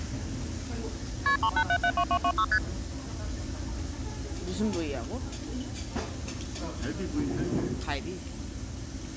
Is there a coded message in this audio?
Yes: multi-frequency trunk signalling (R1, as on North American trunks) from 1.3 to 2.6 s, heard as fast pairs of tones, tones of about 70 ms, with the noise of a crowd indoors. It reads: KP 38772226 ST